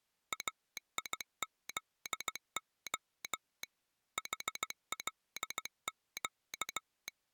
Morse code (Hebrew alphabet), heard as a telegraph sounder, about 16 wpm. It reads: איזה חלק